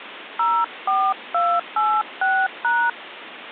DTMF, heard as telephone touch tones, dialled by hand, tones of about 250 ms, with phone line noise. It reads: 04286#